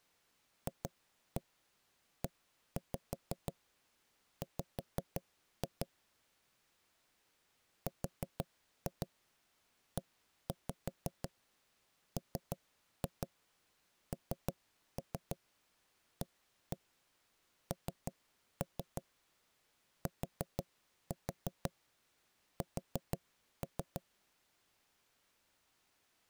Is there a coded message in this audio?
Yes: tap code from 0.7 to 24.0 s, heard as knocks on wood, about 6 knocks a second. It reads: FEW REMNANTS